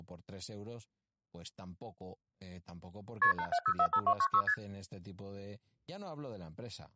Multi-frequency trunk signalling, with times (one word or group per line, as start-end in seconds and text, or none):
3.2-3.3 KP
3.4-4.4 87045296
4.5-4.5 ST